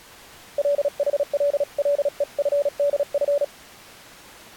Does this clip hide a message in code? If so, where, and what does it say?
Yes: Morse code (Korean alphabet) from 0.5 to 3.5 s, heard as a keyed tone, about 36 wpm, 570 Hz. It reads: 국가는